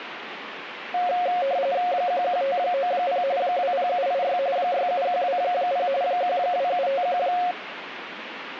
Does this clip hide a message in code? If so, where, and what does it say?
Yes: RTTY (45.45 baud, 170 Hz shift) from 0.9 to 7.5 s, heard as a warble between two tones, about 630 Hz centre, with radio static. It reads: 11590 20786 67120 12751